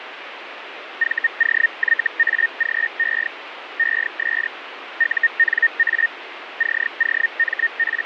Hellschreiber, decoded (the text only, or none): VOYAGE ES UNA …